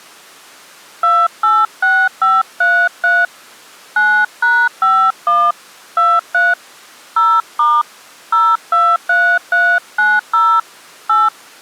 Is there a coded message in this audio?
Yes: DTMF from 1.0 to 11.3 s, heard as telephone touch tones, dialled by hand, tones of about 240 ms. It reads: 286533 9#51 23 0* 023390 8